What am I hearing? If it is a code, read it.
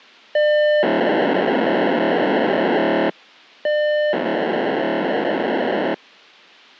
POCSAG pager data (1200 baud), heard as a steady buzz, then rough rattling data.